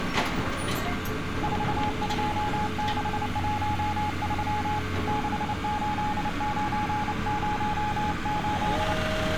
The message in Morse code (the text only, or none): 42613 68908